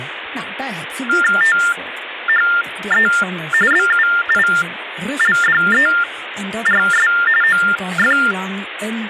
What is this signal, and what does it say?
TTY/TDD text telephone tones (45.45 baud Baudot), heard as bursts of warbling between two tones, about 400 Hz shift, 1600 Hz centre, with phone line noise and speech in Dutch. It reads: THE BUILDERS OF